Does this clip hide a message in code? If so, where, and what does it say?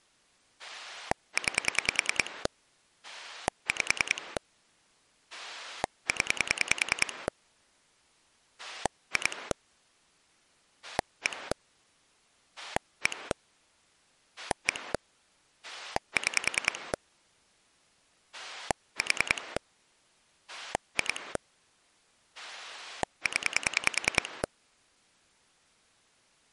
Yes: pulse dialling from 0.6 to 24.5 s, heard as a rotary dial, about 10 pulses a second. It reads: 9 5 0 2 1 1 1 6 4 2 0